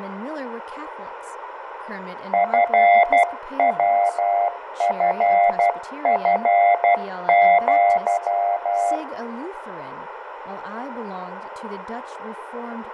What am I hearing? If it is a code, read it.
Morse code (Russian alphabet), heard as a keyed tone, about 12 wpm, 700 Hz, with radio static, fading, room echo and speech in English. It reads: ФВФФЪ